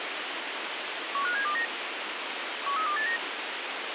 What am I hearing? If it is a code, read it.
Five-tone selective call (CCIR), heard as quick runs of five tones, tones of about 100 ms, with radio hiss. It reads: 15729 13289